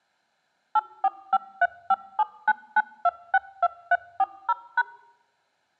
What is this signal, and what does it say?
DTMF, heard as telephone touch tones, dialled by machine, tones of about 40 ms. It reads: 84535799262340#